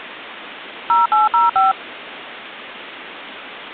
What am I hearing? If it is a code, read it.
DTMF, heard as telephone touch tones, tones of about 160 ms. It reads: 0805